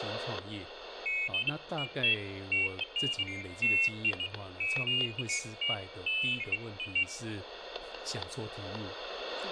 Pairs of high tones at irregular times, with static crashes, room echo and speech in Chinese. There is no code.